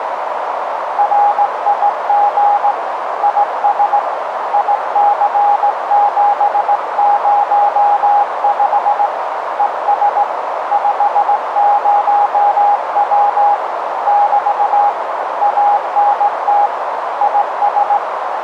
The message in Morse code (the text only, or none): RIG IS IC705 ES 50W <BT> ANT IS